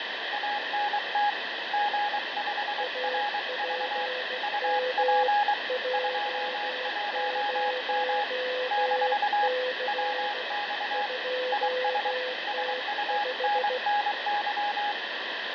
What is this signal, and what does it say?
Morse code, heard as two keyed tones, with heavy radio static and fading. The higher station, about 23 wpm, 830 Hz: ANT G5RV UP 21M - WX IS SUNNY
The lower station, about 16 wpm, 510 Hz: APM J0C 2T5